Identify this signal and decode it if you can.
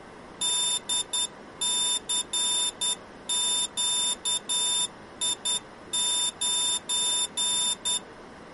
Morse code, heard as a high beeper, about 10 wpm, 3600 Hz. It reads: DCQI9